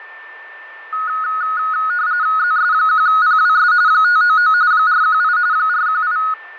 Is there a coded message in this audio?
Yes: RTTY (45.45 baud, 170 Hz shift) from 0.9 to 6.3 s, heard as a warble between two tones, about 1360 Hz centre, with radio static, fading and a steady whistle near 1780 Hz. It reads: ZS1PWS 599 418 418